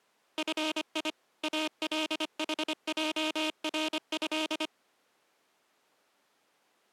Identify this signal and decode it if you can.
Morse code (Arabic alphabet), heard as a buzzer, machine-sent, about 25 wpm. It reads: في الحجره